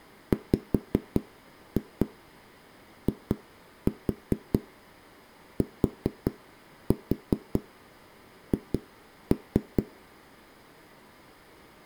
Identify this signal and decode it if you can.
Tap code, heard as knocks on a wall, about 4 knocks a second. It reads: WITH